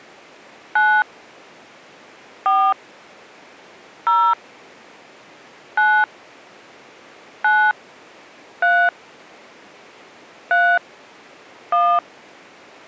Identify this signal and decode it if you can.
DTMF, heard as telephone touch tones, dialled by hand, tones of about 270 ms. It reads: 9 4 0 9 9 3 3 1